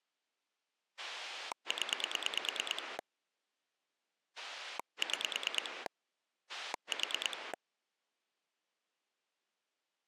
Pulse dialling, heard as a rotary dial, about 9 pulses a second. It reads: 0 6 4